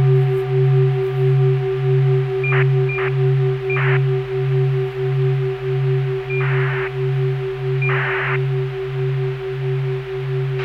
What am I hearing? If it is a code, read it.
ACARS aircraft data, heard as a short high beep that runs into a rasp, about 2400 baud, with radio hiss and a squelch burst at the end.